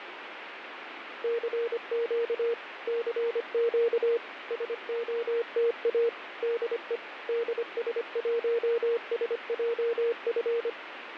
Morse code, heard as a keyed tone, machine-sent, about 25 wpm, 470 Hz, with radio static. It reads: CQ CQ SOTA DE DS1SJF